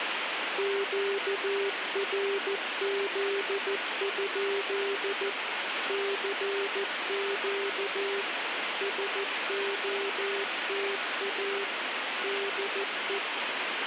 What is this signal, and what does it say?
Morse code, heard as a keyed tone, machine-sent, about 14 wpm, 400 Hz, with heavy radio static. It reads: QRZ? CQ SOTA DE